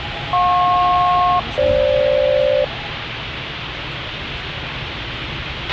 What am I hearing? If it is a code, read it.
Aircraft SELCAL, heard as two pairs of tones, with radio hiss, a squelch burst at the end and the noise inside a subway train. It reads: JP-FG